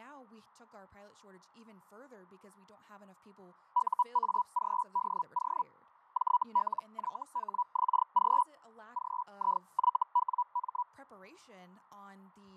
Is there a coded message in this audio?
Yes: Hellschreiber (Feld-Hell, 122.5 baud) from 3.7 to 10.8 s, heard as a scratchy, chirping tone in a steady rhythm, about 980 Hz, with fading and speech in English. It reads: UAGDO JLYHXG GIYWM